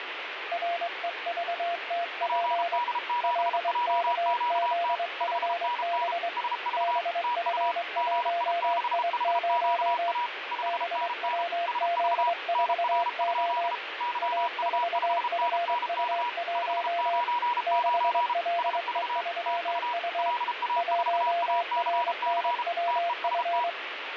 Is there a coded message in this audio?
Yes: Morse code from 0.5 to 23.8 s, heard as two keyed tones, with radio static. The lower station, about 23 wpm, 690 Hz: REVTP LKZFB BF1I0 BWZ4O A4FU1 6LE3U 1RNWF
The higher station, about 33 wpm, 970 Hz: PD7JQT 5NN SV TU GI6HQA 5NN SV NR? YU5NNK 599 SV TU LA4ACC TEST